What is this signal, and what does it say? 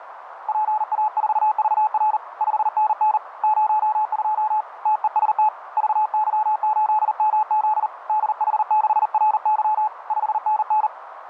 Morse code, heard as a keyed tone, hand-sent with a paddle, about 39 wpm, 860 Hz, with radio static and a narrow filter. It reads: PA4VR 5NN 02 TEST VY8MZ DH6RY 5NN